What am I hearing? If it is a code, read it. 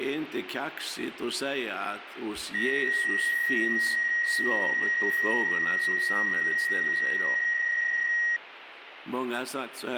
PSK63 (62.5 baud), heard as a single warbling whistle, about 1900 Hz.